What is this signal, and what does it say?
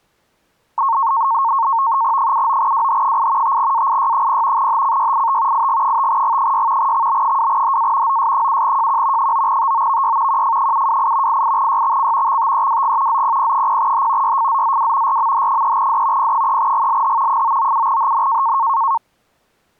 NAVTEX (SITOR-B), 100 baud, 170 Hz shift, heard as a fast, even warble, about 1000 Hz centre. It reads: 79WH8 5AIY0 HCYIT IG5G6 XB2HA OS7JQ 9TOVY QF728 88YXC XTEWG ZPP0H YFZZW RMH3D P3GLH 997HN